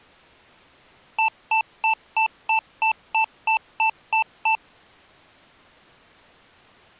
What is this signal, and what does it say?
Beep code, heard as beeps from a small speaker, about 890 Hz. 11 short. In AMI BIOS tables: cache memory error.